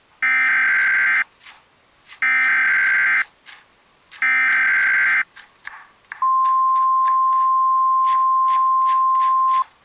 Emergency Alert System (SAME) tones (header bursts, then the 1050 Hz attention tone), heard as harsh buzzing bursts, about 520.83 baud, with kitchen noise.